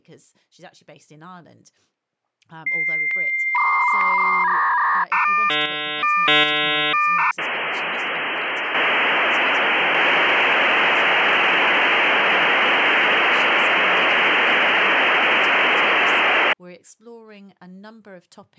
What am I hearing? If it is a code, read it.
Dial-up modem handshake (V.34 or later), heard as a whistle, warbles, then hiss, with speech in English.